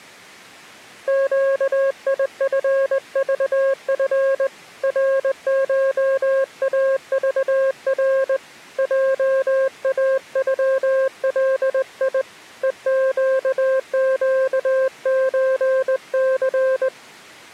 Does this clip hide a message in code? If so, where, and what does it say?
Yes: Morse code (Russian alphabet) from 1.0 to 16.9 s, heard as a keyed tone, hand-sent with a straight key, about 20 wpm, 530 Hz. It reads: ЩИФЖФ РШАЖР ЙАЮЛИ ЕЩЩЧЦ